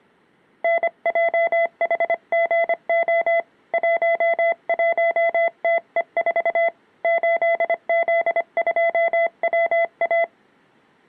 Morse code, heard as a keyed tone, hand-sent with a paddle, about 25 wpm, 670 Hz. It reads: NJHGO 11TE4 8Z2WA